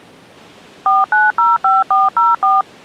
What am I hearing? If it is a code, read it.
DTMF, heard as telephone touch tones, dialled by machine, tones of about 180 ms. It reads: 4905404